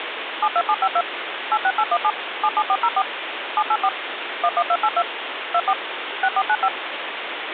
DTMF, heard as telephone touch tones, dialled by machine, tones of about 60 ms, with phone line noise. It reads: 72752 86817 77404 784 11282 24 6495